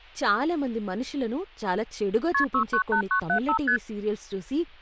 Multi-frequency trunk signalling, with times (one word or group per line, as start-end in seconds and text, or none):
2.3-2.4 KP
2.5-3.6 698975
3.7-3.8 ST